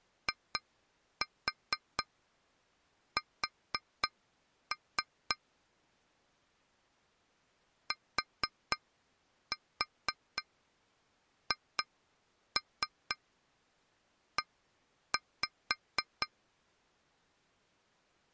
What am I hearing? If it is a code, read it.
Tap code, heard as taps on glass, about 4 knocks a second. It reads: IS THE